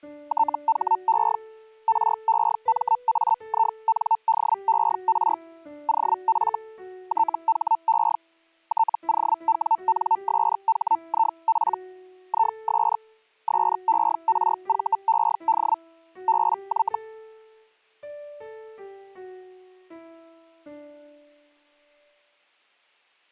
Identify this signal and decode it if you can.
Hellschreiber (Feld-Hell, 122.5 baud), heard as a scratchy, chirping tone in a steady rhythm, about 900 Hz. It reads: THE REMAINDER OF THE TOWNSHIP IS SERVED BY